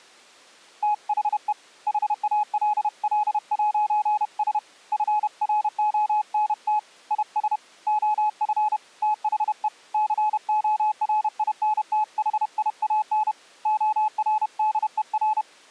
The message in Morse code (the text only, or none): THE HALL'S FRONT IS OF THE CORINTHIAN ORDER